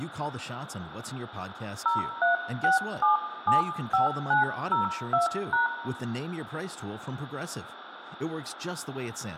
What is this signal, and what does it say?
DTMF, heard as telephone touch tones, dialled by hand, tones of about 130 ms, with phone line noise, room echo and speech in English. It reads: 036775902#